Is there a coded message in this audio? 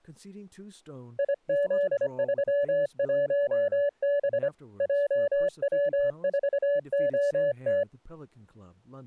Yes: Morse code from 1.1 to 7.9 s, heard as a keyed tone, hand-sent with a paddle, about 25 wpm, 570 Hz, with speech in English. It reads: IZ31B JW4OT